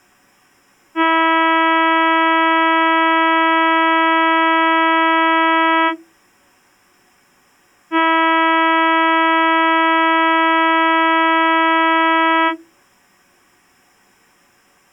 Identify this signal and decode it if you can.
Ship horn signal, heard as a ship's horn, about 320 Hz. 2 long. At sea: a vessel under power that has stopped in fog.